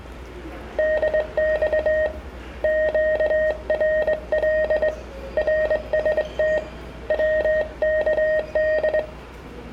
Morse code, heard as a keyed tone, hand-sent with a straight key, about 22 wpm, 620 Hz, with the noise of a subway station. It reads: DX QRL RST WKD